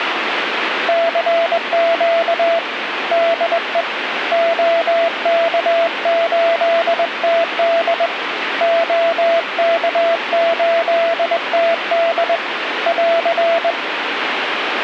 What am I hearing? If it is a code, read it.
Morse code, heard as a keyed tone, hand-sent with a straight key, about 21 wpm, 670 Hz, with radio static. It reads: CQ DE OK8TD OK8TD <AR>